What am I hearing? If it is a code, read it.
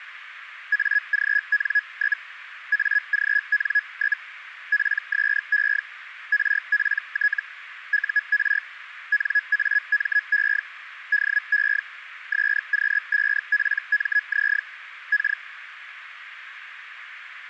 Hellschreiber (Feld-Hell, 122.5 baud), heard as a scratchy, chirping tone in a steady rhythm, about 1700 Hz, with radio static. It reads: AGN? AGN? PSE RPT UR NAME DE SQ5PMZ K